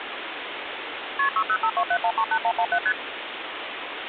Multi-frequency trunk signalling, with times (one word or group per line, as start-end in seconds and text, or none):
1.2-1.3 KP
1.4-2.8 60527138117
2.9-2.9 ST